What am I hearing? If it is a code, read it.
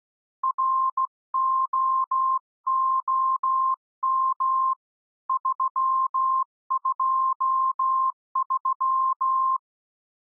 Morse code, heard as a keyed tone, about 16 wpm, 1050 Hz. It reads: ROOM 323